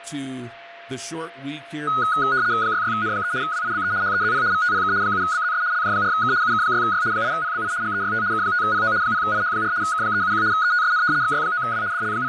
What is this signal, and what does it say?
RTTY (75 baud, 170 Hz shift), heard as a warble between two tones, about 1360 Hz centre, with fading and a steady whistle near 680 Hz. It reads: 66N3 WIBE HEZP VTPK 7BZS LJ4K UK6Y 8PBI GEYT K5PO 0IH4 K371 ETSN XY9W …